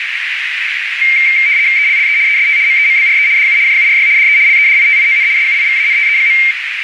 RTTY (75 baud, 170 Hz shift), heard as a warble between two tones, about 2200 Hz centre, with radio static and a narrow filter. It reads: ELLE EST MEMBRE DU JURY DE LEDITION SUIVANTE.